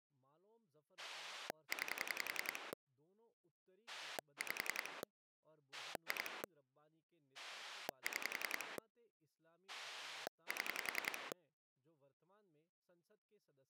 Pulse dialling, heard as a rotary dial, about 10 pulses a second, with speech in Hindi. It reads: 9 5 2 6 7